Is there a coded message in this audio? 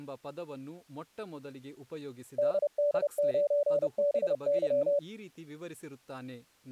Yes: Morse code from 2.3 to 5.0 s, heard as a keyed tone, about 30 wpm, 580 Hz, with speech in Kannada. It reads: DD9BY